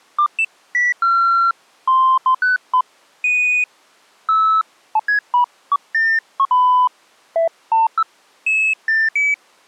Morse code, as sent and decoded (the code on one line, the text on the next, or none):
none